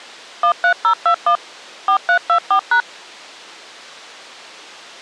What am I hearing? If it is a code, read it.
DTMF, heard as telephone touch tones, dialled by machine, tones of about 90 ms. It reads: 13021 4324#